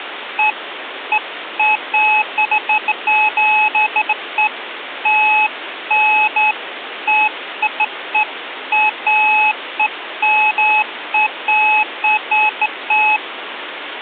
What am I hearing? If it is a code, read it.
Beeps of irregular length, with phone line noise. There is no code.